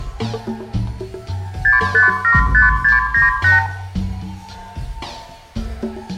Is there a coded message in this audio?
Yes: multi-frequency trunk signalling (R2, with the far end's replies) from 1.6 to 3.7 s, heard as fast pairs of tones, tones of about 150 ms, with room echo. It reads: 6575698